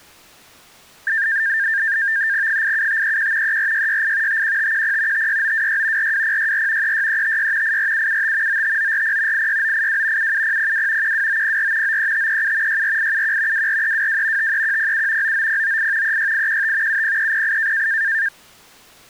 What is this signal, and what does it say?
NAVTEX (SITOR-B), 100 baud, 170 Hz shift, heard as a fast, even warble, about 1700 Hz centre. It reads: 87531 34668 51510 56926 42064 36356 84775 95940 86982 77002 12904 93537 64871 24322 53107 99098 36815 70308